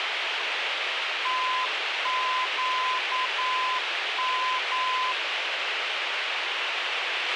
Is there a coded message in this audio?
Yes: Morse code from 1.2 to 5.2 s, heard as a keyed tone, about 9 wpm, 1020 Hz, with radio hiss and a squelch burst at the end. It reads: TQM